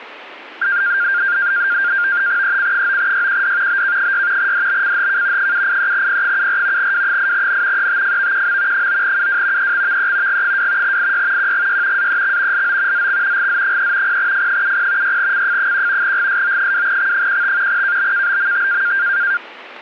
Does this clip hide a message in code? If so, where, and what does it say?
Yes: NAVTEX (SITOR-B), 100 baud, 170 Hz shift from 0.6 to 19.4 s, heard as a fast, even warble, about 1500 Hz centre. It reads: EC9YQD BK6 DBCHK 783P74 W8N ETFVQM 9UW EXVE G2 IY QGY AEX LO ZX GZ3 0F70 6CF1 GSO2X15 KBKBMT